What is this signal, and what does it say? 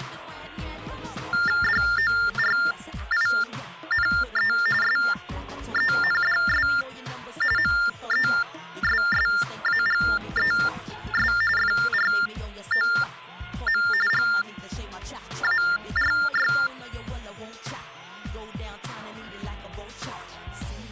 TTY/TDD text telephone tones (45.45 baud Baudot), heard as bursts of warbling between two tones, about 400 Hz shift, 1600 Hz centre. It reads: DORINE SENDS MESSAGES FROM GARY